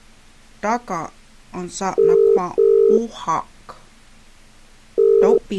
Telephone call progress tone (as in the UK, Ireland, Australia and similar networks), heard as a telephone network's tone, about 400, 450 Hz. Ringback tone.